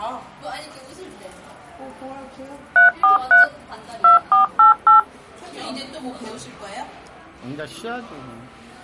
DTMF, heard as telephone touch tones, dialled by machine, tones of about 130 ms, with the noise of a cafe. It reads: 343 2488